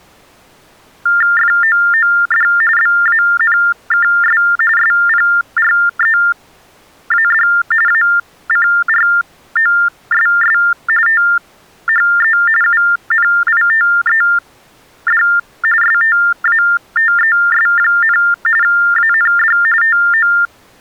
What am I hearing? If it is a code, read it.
TTY/TDD text telephone tones (45.45 baud Baudot), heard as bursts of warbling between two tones, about 400 Hz shift, 1600 Hz centre. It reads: FOOD BANKS SPREAD ACROSS THE UNITED STATES, AND TO